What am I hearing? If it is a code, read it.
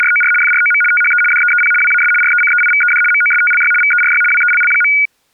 RTTY (75 baud, 850 Hz shift), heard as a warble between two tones, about 1850 Hz centre. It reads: … FROM THE DEEP WAS RECEIVED MOSTLY VERY WELL.